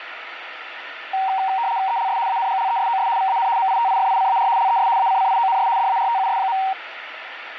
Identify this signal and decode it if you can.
RTTY (75 baud, 170 Hz shift), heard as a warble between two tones, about 850 Hz centre, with radio static. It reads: ELS ANGLESOS VAN MITIFICAR LES ACCIONS DARTUS.